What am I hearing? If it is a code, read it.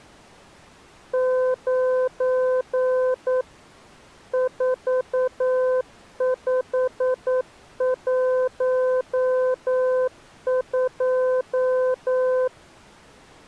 Morse code, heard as a keyed tone, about 9 wpm, 510 Hz. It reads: 9 4512